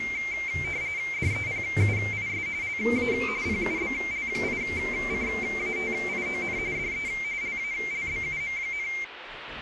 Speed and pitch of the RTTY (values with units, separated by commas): 45.45 baud, 170 Hz shift, 2200 Hz centre